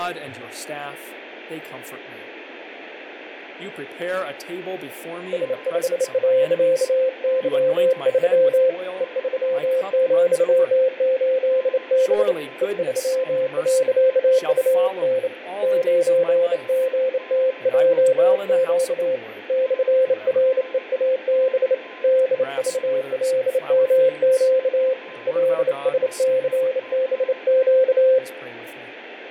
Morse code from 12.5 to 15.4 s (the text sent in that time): E3.UN